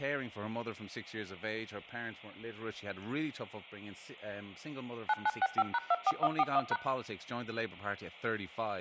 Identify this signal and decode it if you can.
DTMF, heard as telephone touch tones, dialled by machine, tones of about 40 ms, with speech in English. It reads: 9965#24141#